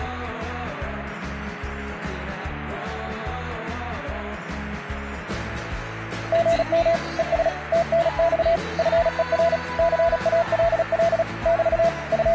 Morse code, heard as a keyed tone, machine-sent, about 36 wpm, 680 Hz. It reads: GM ES TNX FER CALL <BT> …